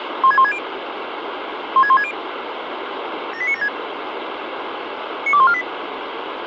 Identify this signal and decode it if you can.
Five-tone selective call (ZVEI), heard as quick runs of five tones, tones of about 70 ms, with radio hiss and a squelch burst at the end. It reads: 16160 16160 78976 92148